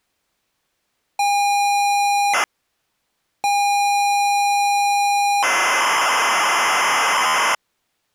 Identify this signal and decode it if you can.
ZX Spectrum tape loading, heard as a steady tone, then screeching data.